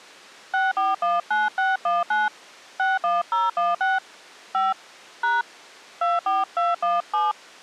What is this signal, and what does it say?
DTMF, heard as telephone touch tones, dialled by hand, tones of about 180 ms. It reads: 6419619 61016 5 # 24217